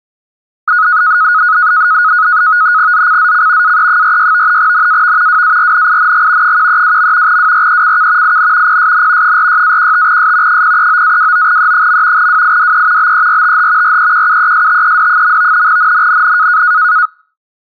NAVTEX (SITOR-B), 100 baud, 170 Hz shift, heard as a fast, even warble, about 1360 Hz centre. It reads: ZCZC AE46 NAV WARNING 132. WRECK IN PSN 46-15S 039-29E. WIDE BERTH REQUESTED. NNNN